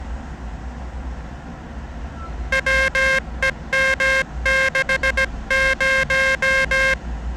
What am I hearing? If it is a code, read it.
Morse code, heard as a buzzer, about 17 wpm, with the noise of a residential street. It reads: WEM60